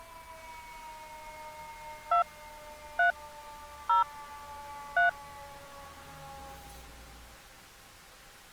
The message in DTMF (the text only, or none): 2 3 0 3